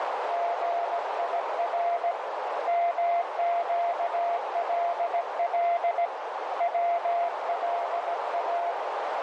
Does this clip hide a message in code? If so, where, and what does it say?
Yes: Morse code (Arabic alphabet) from 0.2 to 8.8 s, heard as a keyed tone, hand-sent with a paddle, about 17 wpm, 690 Hz, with heavy radio static and a narrow filter. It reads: غير مقلل ولا